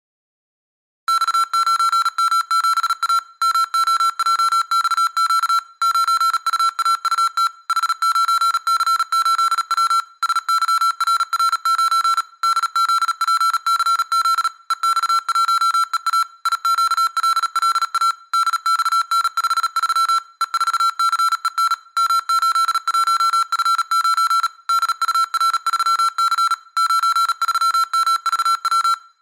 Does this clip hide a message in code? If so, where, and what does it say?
Yes: Morse code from 1.0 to 29.0 s, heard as electronic beeps, machine-sent, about 37 wpm, 1350 Hz, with room echo. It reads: X9M7A MOJXQ 9UAUT H9C8W SYRR9 DZPCZ EX1EA IQLLA DXN53 E4CEN M81F9 DUR3C 93MVW